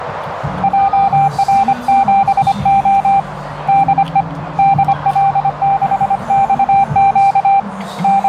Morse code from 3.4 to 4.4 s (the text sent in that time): DE